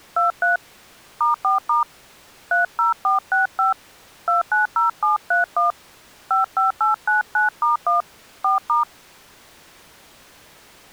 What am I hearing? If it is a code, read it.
DTMF, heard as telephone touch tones, dialled by hand, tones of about 140 ms. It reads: 23 *4* 30465 290731 55899*1 4*